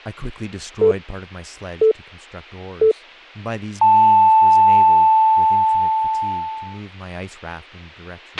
Radio time signal (three low pips and a long one an octave up, as on NHK), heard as pips, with a squelch burst at the end and speech in English.